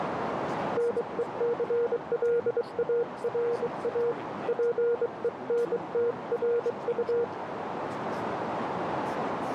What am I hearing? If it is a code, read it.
Morse code, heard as a keyed tone, hand-sent with a bug key, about 23 wpm, 470 Hz, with radio static, a narrow filter and speech in English. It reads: NECLARA PENTRU